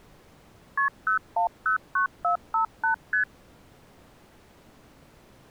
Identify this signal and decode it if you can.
Multi-frequency trunk signalling (R1, as on North American trunks), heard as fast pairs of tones, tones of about 110 ms. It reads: KP 0109458 ST